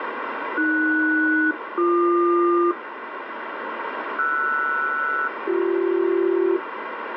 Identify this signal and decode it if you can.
Aircraft SELCAL, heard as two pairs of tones, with heavy radio static. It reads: AS-BQ RS-BC